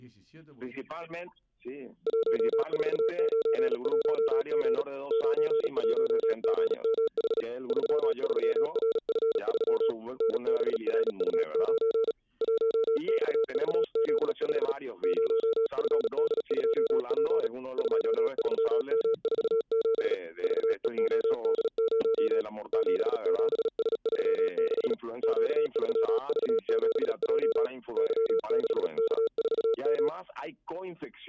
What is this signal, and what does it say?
Morse code, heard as a keyed tone, hand-sent with a paddle, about 37 wpm, 450 Hz. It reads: 1491G 91GMH 33RF3 NBRU9 1XVZ5 0FD2P 23M47 VEOD0 77S36 Q3V7J Y6K4M